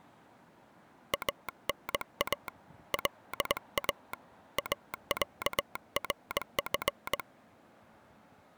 Morse code (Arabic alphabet), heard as a telegraph sounder, hand-sent with a straight key, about 19 wpm, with street noise. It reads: انا لا اعرف